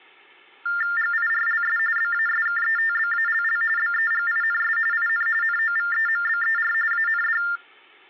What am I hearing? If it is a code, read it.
TTY/TDD text telephone tones (45.45 baud Baudot), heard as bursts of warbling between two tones, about 400 Hz shift, 1600 Hz centre. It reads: GIRLS BASKETBALL BEGINS IN NOVEMBER AND